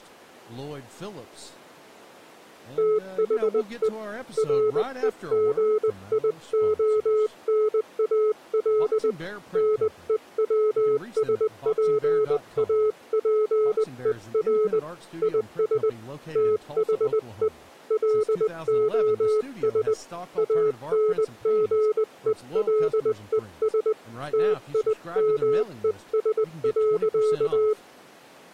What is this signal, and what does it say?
Morse code, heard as a keyed tone, hand-sent with a paddle, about 20 wpm, 430 Hz, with speech in English. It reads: THE REGIONAL NEWSPAPER IS THE LOS ANGELES TIMES.